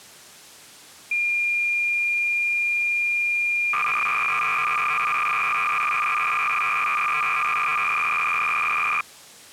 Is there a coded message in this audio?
Yes: cassette data (Kansas City type), 300 baud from 1.1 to 9.0 s, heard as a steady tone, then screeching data.